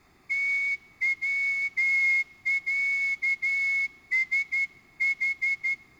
Morse code (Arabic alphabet), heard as a whistle, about 12 wpm, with room echo. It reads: توعسح